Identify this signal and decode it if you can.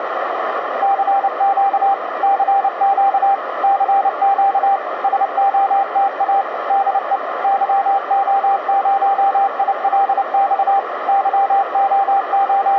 Morse code, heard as a keyed tone, machine-sent, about 29 wpm, 790 Hz, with radio static and a narrow filter. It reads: CQ CQ CQ SOTA DE YO0ILX …